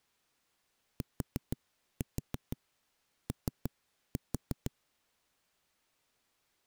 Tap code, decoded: TO

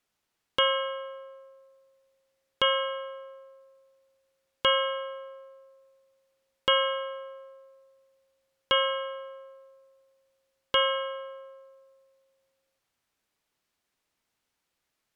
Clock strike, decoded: 6

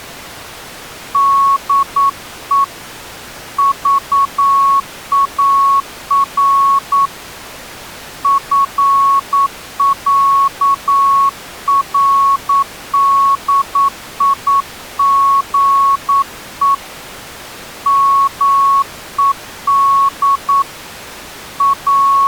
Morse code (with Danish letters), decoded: DE VAR FÆRDIGE MED …

